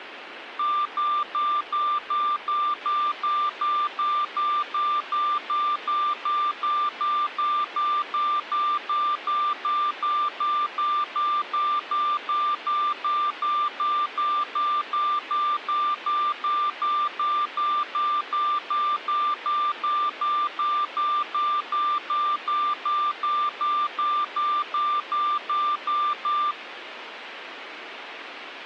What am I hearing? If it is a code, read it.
Evenly repeated beeps, with radio hiss. There is no code.